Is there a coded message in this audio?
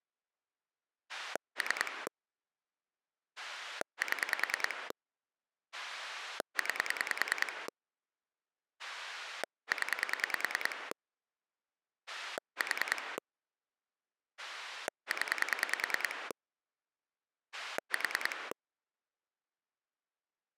Yes: pulse dialling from 1.1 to 18.5 s, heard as a rotary dial, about 10 pulses a second. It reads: 3 7 9 0 4 0 4